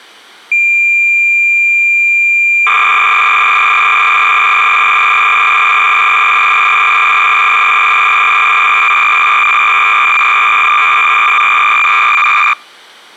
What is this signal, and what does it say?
Cassette data (Kansas City type), 300 baud, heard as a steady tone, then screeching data.